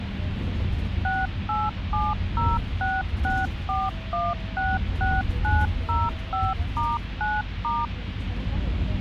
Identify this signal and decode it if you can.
DTMF, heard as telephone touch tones, dialled by machine, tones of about 210 ms, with phone line noise and the noise inside a bus. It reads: 6870664166905*9*